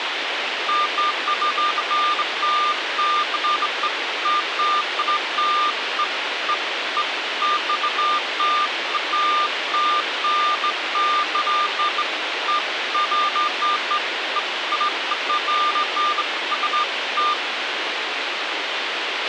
Beeps of irregular length, with radio hiss and a squelch burst at the end. There is no code.